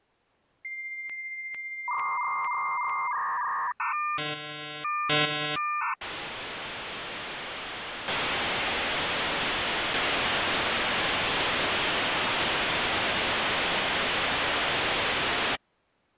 Dial-up modem handshake (V.34 or later), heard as a whistle, warbles, then hiss.